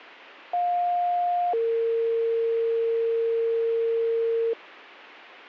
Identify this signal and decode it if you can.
Two-tone page, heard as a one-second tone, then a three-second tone, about 710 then 460 Hz.